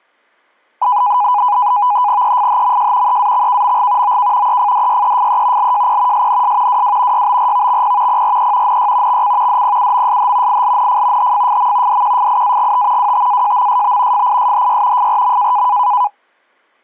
NAVTEX (SITOR-B), 100 baud, 170 Hz shift, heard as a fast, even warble, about 910 Hz centre. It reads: EFHMJ EAXKMG OK EFDYEFE LJP SNS WW YBRVXP PRE NY XC DPUMSH ILNF HFFM DQFIAGT WTAJMSB FISHY FRM